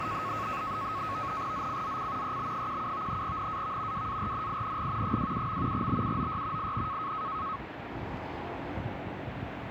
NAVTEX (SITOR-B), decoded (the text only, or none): ZCZC EB17 NAV WARNING 27. BUOY IN